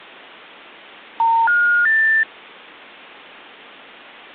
Telephone call progress tone (North American plan), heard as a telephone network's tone, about 910, 1430, 1800 Hz. Special information tone.